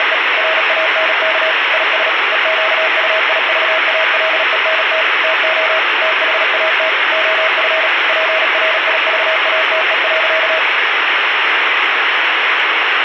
Morse code, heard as a keyed tone, machine-sent, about 37 wpm, 640 Hz, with radio static. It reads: … RANK IS EQUIVALENT TO THAT OF PRIVATE.